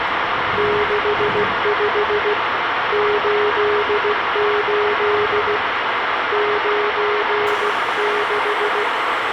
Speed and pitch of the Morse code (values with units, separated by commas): 16 wpm, 420 Hz